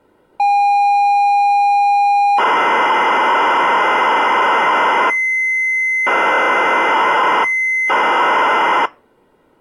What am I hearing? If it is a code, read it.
ZX Spectrum tape loading, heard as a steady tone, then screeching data.